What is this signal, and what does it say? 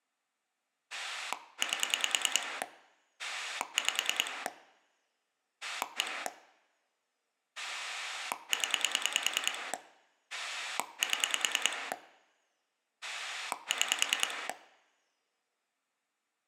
Pulse dialling, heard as a rotary dial, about 10 pulses a second, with room echo. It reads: 8 5 1 0 7 6